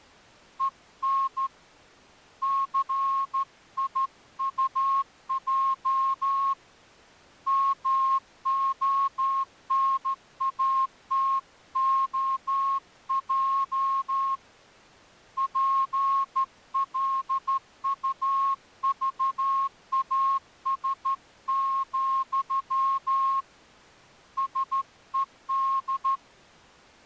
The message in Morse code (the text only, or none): EN CIUJ MONATOJ PLUVAS, SED